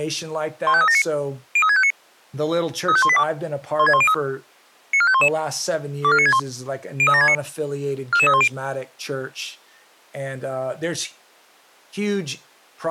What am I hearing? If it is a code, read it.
Five-tone selective call (ZVEI), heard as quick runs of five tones, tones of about 70 ms, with speech in English. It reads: 15379 03659 35182 16103 94511 24961 03769 44310